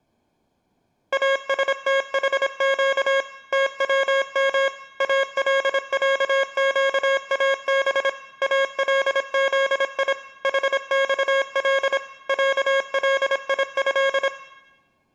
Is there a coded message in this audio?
Yes: Morse code (Arabic alphabet) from 1.1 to 14.3 s, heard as electronic beeps, machine-sent, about 26 wpm, 540 Hz, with room echo. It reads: استحق توم العقاب الذي حصل عليه